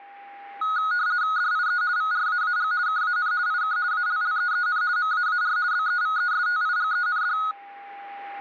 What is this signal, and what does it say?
RTTY (50 baud, 170 Hz shift), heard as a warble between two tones, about 1360 Hz centre, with a steady whistle near 800 Hz. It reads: DIE VRAAG KAN IK ALLEEN MAAR BEVESTIGEND